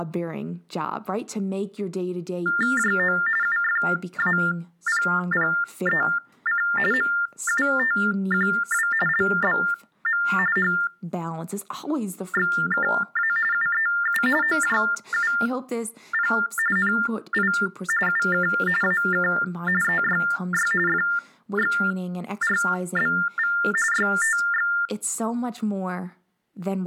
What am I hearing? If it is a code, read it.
TTY/TDD text telephone tones (45.45 baud Baudot), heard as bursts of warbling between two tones, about 400 Hz shift, 1600 Hz centre, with speech in English. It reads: JO UFAPPEC MUTQW LBM HXKA UEU OJUP NI UK AK EYY FXRBV YTX